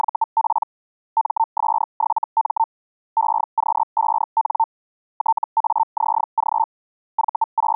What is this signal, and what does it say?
Hellschreiber (Feld-Hell, 122.5 baud), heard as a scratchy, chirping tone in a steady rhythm, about 900 Hz. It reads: … MS7M EQ5N TAZG …